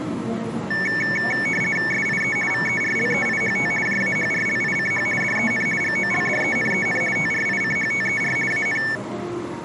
RTTY (50 baud, 450 Hz shift), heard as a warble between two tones, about 2000 Hz centre, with the noise of a crowd indoors. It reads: SIE VERLEIHT JAHRLICH DEN GOLDENEN TRICHTER AN